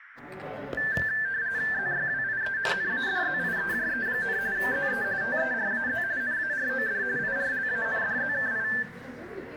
RTTY (45.45 baud, 170 Hz shift), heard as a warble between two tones, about 1650 Hz centre, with radio static, room echo and the noise of a crowd indoors. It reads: ZYWIE NADZIEJE, ZE TERAZ NAROD IRLANDZKI